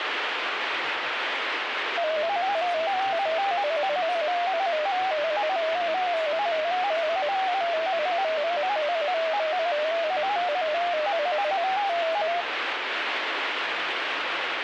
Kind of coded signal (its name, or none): multi-tone FSK (Olivia or MFSK type)